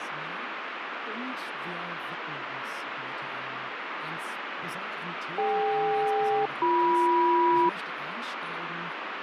Aircraft SELCAL, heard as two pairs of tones, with radio static. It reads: DK-BM